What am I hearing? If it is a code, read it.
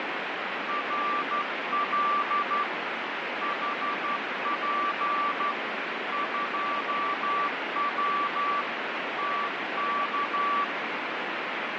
Morse code, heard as a keyed tone, hand-sent with a straight key, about 12 wpm, 1160 Hz, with heavy radio static. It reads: RL HP 2W TK